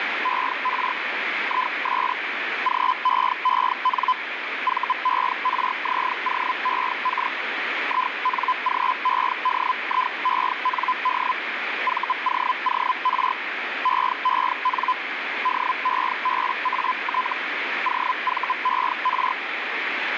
Hellschreiber (Feld-Hell, 122.5 baud), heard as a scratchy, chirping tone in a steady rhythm, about 1010 Hz, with radio static. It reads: ER IS GEEN VERZOEK INGEDIEND VOOR EEN DEBAT OVER